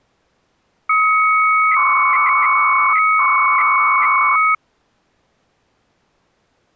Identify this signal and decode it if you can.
300-baud modem data (Bell 103 tones), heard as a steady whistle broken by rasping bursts, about 300 baud, 200 Hz shift.